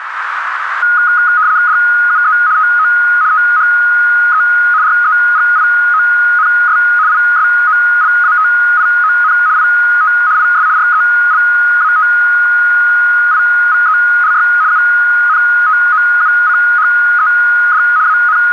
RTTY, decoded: DUE TO THE REGIONS ISOLATION IT IS RELATIVELY UNTOUCHED …

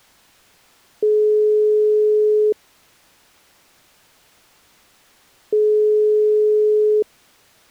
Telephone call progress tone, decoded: ringback tone

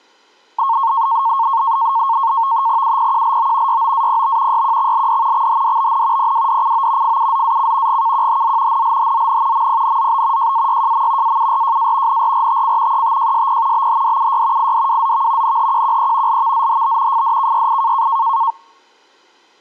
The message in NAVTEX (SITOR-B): UPQLO YOAPB YQXLD XHDBN PWDCO FUZAC GKQHZ NLHZN MPNZB JAYJM AURJA NRRTC ETJSP BHDUY IDWZV NHQQE LVZHB FDKYI

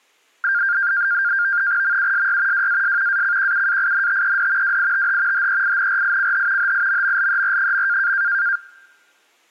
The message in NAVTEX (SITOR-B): MUSY WAS ACQUAINTED WITH HEINRICH HIMMLER.

